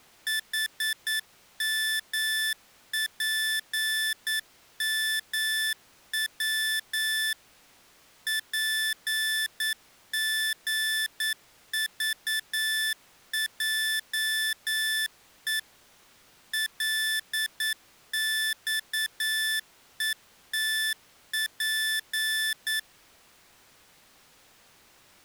Morse code, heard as electronic beeps, machine-sent, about 9 wpm, 1750 Hz. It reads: HMPMW PGVJE LXETP